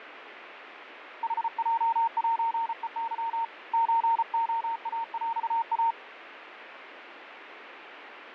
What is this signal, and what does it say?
Morse code (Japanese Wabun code), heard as a keyed tone, hand-sent with a paddle, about 34 wpm, 920 Hz, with radio static. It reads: ヌヲセヘケ ソレイヰイ